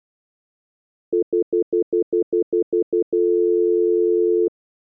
Telephone call progress tone (North American plan), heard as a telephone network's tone, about 350, 440 Hz, 0.1 s on and 0.1 s off. Stutter dial tone.